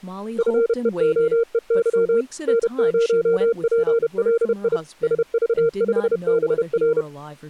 Morse code, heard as a keyed tone, machine-sent, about 31 wpm, 460 Hz, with speech in English. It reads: FEOEY N0PLI SV5BR